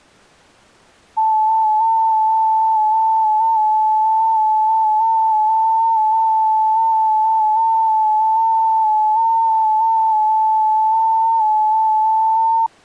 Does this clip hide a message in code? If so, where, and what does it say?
Yes: FT8 (one signal) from 1.2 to 12.7 s, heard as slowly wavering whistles, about 6.25 baud.